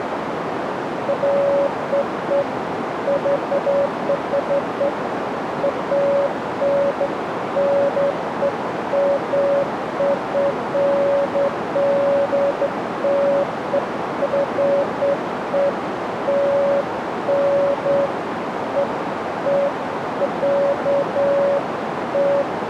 Beeps of irregular length, with radio static and a narrow filter. There is no code.